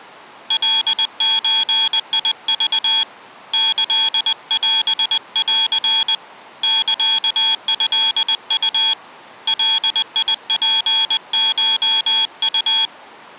Morse code (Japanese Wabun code), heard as a high beeper, hand-sent with a paddle, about 20 wpm, 3300 Hz. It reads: カゾク キオン サトウ ガツコウ